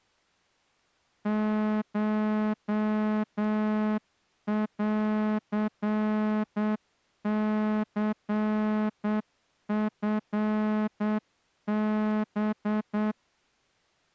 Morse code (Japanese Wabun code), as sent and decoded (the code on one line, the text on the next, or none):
---- .-.-. -.-. ..-. -...
コンニチハ